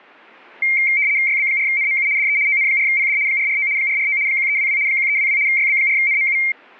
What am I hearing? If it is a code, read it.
RTTY (75 baud, 170 Hz shift), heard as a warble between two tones, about 2200 Hz centre. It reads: YB4NMU DE ON4PD 449 449 1322 1322 YB4NMU